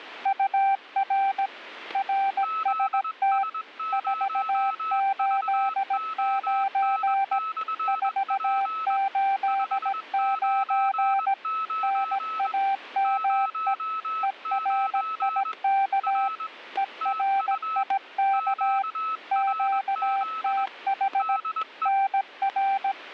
Morse code, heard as two keyed tones, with static crashes. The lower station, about 17 wpm, 780 Hz: UR RST 489 489 NAME ERIK ERIK QTH NR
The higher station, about 21 wpm, 1300 Hz: ZS0VON/P 599 09 R TU QRZ DE